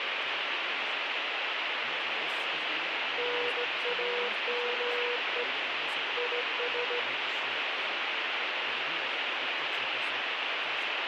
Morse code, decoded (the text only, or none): NAME IS